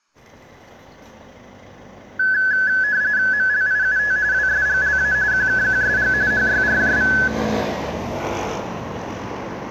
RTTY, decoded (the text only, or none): MLIUT WSGLA QKQSG HYRJV